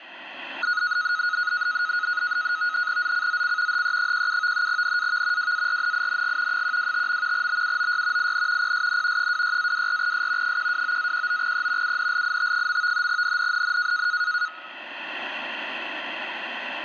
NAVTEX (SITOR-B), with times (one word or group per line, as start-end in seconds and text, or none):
3.0-3.8 ZCZC
3.7-4.7 HE17
4.7-5.5 NAV
5.4-6.6 WARNING
6.5-7.5 125.
7.3-8.3 BUOY
8.2-8.7 IN
8.6-9.3 PSN
9.2-10.6 26-24S
10.4-12.0 129-19E
11.8-13.1 UNLIT.
13.1-14.1 NNNN